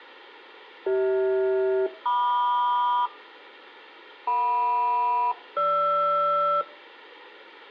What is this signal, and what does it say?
Aircraft SELCAL, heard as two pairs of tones. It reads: CH-MQ JM-GR